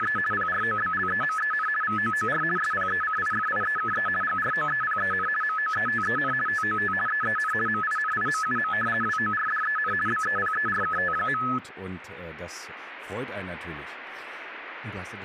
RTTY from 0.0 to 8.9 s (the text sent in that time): … PROBLEMEN VOOR SPECIFIEKE GROEPEN MOETEN TOT EEN MINIMUM